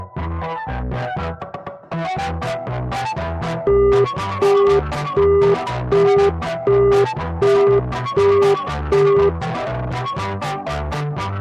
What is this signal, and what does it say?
Telephone call progress tone (as in the UK, Australia and similar networks), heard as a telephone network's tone, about 400 Hz, 0.375 s on and 0.375 s off. Busy tone.